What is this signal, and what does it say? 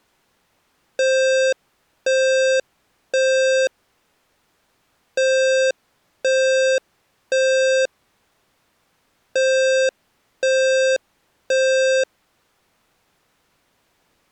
Alarm pattern, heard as an alarm's beeps, played three times, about 530 Hz. Temporal three. Smoke or fire, evacuate.